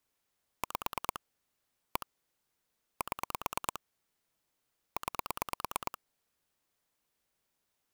Pulse dialling, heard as clicks on a phone line, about 9 pulses a second. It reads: 5 1 7 9